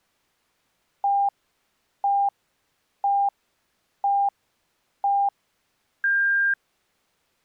Radio time signal (five pips and a higher one, as on Chinese radio), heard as pips.